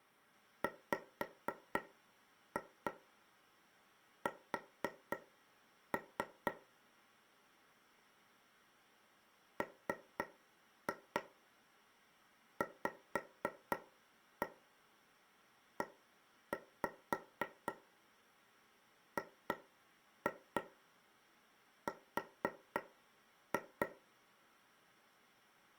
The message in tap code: WS MVEGR

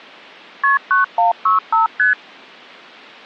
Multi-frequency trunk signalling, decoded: KP 9165 ST

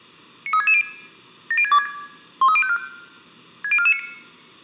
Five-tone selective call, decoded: 93660 70626 13054 60449

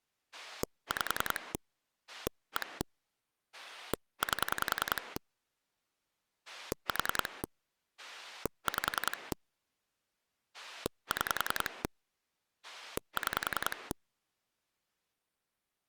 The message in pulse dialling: 5 1 8 4 5 6 6

